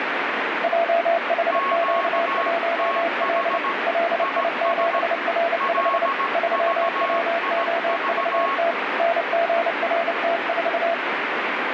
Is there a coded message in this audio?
Yes: Morse code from 0.6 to 11.0 s, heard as two keyed tones, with heavy radio static. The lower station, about 29 wpm, 680 Hz: JHQ1L LI7R5 3WOVT NGRT4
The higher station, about 17 wpm, 1100 Hz: QTH IS LVIV